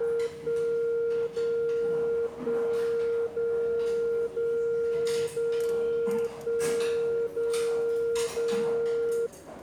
Radio time signal (DCF77), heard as a tone whose level steps once a second, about 460 Hz, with the noise of a restaurant. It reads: 1 0 1 0 0 0 1 0 0